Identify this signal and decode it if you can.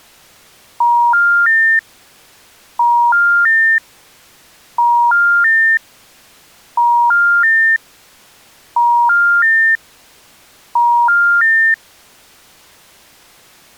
Telephone call progress tone (ITU plan), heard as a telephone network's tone, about 950, 1400, 1800 Hz. Special information tone.